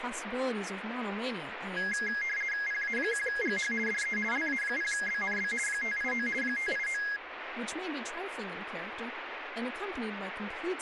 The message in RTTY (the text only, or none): PA1GH DE LA0BNB 589 589